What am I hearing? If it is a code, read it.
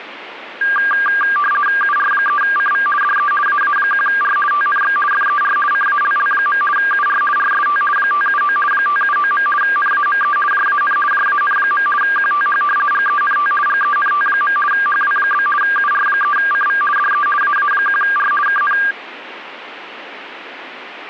RTTY (50 baud, 450 Hz shift), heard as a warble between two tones, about 1390 Hz centre, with radio static. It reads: UR3CV DE AA1R TNX FER CALL. UR RST 579 579. NAME JAN JAN. QTH GENT GENT. HW? UR3CV DE AA1R KN